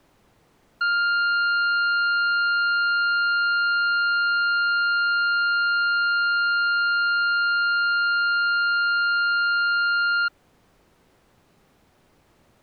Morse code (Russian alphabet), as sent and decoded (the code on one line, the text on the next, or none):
none